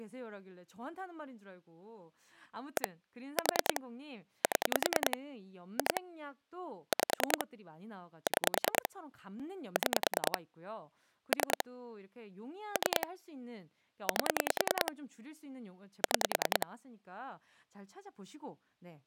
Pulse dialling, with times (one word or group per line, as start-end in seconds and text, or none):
2.8-2.9 1
3.4-3.8 4
4.4-5.2 7
5.8-6.0 2
6.9-7.4 5
8.3-8.9 6
9.8-10.4 6
11.3-11.6 3
12.8-13.1 3
14.1-14.9 8
16.0-16.7 6